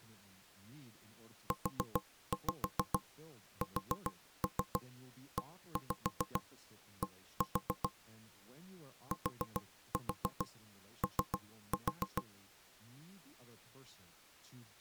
Tap code, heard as knocks on wood, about 7 knocks a second, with speech in English. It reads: USED TO